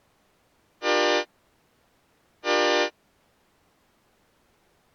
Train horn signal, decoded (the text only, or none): 2 short